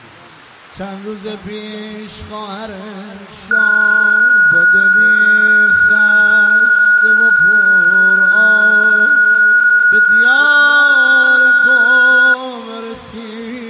PSK31 (31.25 baud), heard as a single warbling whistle, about 1450 Hz.